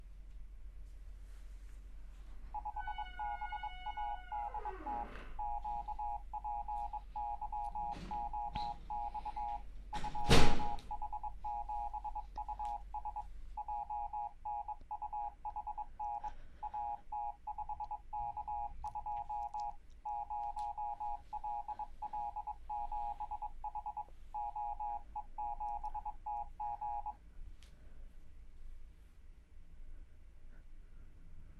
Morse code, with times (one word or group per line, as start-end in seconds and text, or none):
2.5-5.0 5BADT
5.4-9.6 QPYOX
9.9-13.2 2H7US
13.6-16.3 JNUHN
16.6-19.7 AT5K2
20.1-24.0 0LL7H
24.3-27.1 OE7TG